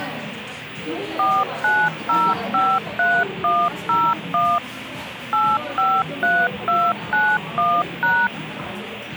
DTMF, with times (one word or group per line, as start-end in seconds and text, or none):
1.2-4.6 49053101
5.3-8.3 853291#